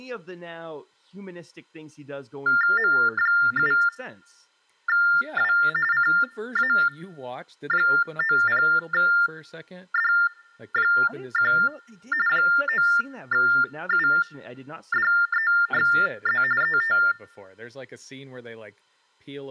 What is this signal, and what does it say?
TTY/TDD text telephone tones (45.45 baud Baudot), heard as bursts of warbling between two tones, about 400 Hz shift, 1600 Hz centre, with speech in English. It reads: M7W CA90D1 9UDEXZ ET